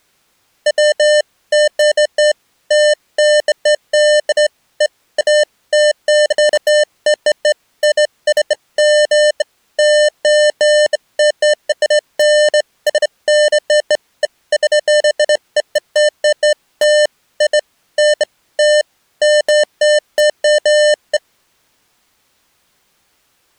Beeps of irregular length. There is no code.